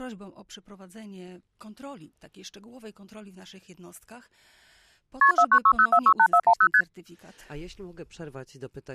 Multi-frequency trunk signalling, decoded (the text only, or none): KP 4960468410 ST